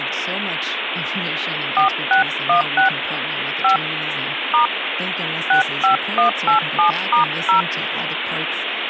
DTMF, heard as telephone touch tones, dialled by hand, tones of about 120 ms, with phone line noise and speech in English. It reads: 4616 5 * 65187*0